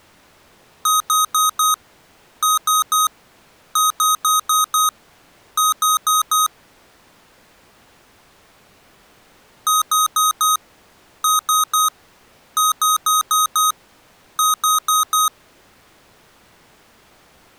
Beep code, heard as beeps from a small speaker, played twice, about 1260 Hz. 4-3-5-4.